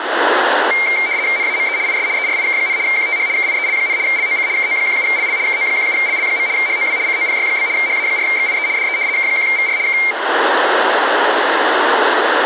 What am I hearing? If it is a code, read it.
RTTY (75 baud, 170 Hz shift), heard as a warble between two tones, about 2200 Hz centre, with radio static and room echo. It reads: NAME IS ERIK, QTH KIEL, LOC KO17LL KO17LL. HOW COPY? HA4XIE DE K1VR K